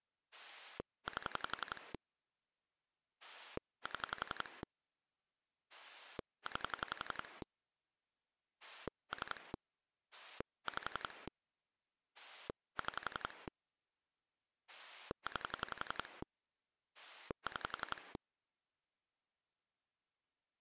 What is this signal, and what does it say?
Pulse dialling, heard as a rotary dial, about 11 pulses a second. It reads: 8 7 9 3 5 6 9 6